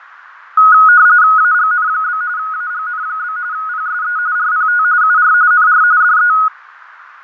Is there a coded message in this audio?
Yes: RTTY (45.45 baud, 170 Hz shift) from 0.6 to 6.5 s, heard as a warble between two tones, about 1360 Hz centre, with radio static, fading and a narrow filter. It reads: AGN? AGN? PSE RPT UR NR DE